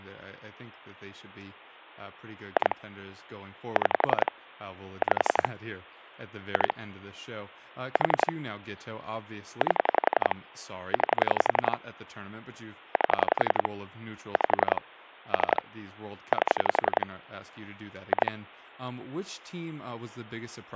Pulse dialling, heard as clicks on a phone line, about 11 pulses a second, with speech in English. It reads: 2 6 5 2 4 8 9 8 5 3 8 2